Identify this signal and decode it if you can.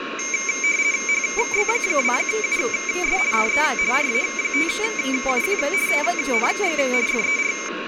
RTTY (50 baud, 170 Hz shift), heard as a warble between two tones, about 2200 Hz centre, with radio static, a steady whistle near 1090 Hz, room echo and speech in Gujarati. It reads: HB2US DE RA5UQ TNX FER